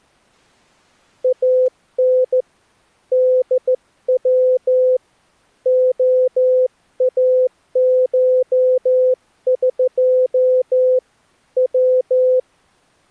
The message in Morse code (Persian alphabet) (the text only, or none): ان دو عاشق و